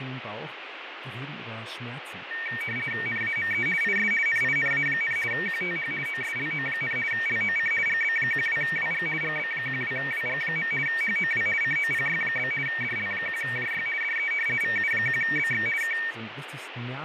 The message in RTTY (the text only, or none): NAME IS NINA, QTH OSLO, LOC GB12WG GB12WG. HOW COPY? DL1JY DE VU1BX K